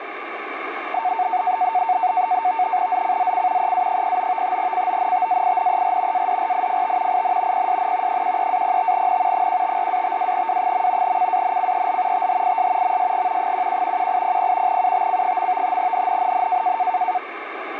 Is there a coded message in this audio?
Yes: NAVTEX (SITOR-B), 100 baud, 170 Hz shift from 0.9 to 17.2 s, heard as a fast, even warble, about 820 Hz centre, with radio static. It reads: ZCZC EA09 CONTAINER ADRIFT IN PSN 13-05N 154-52W. CANCEL THIS MSG 11 1800 UTC. NNNN